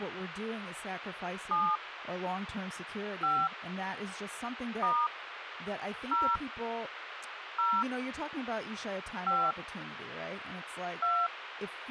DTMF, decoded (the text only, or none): 7 5 * 0 0 5 2